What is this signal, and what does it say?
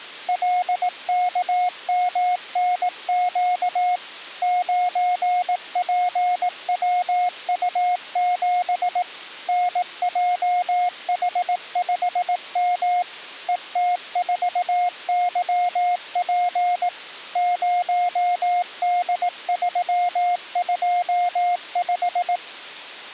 Morse code, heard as a keyed tone, machine-sent, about 18 wpm, 720 Hz. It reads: LKMNQ 9PWU7 NJH5M ET4YP 0D325